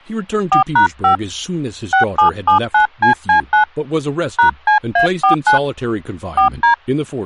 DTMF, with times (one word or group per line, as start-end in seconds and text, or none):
0.5-1.2 4#5
1.9-3.6 6779CC9
4.4-5.6 #CA49
6.4-6.7 4D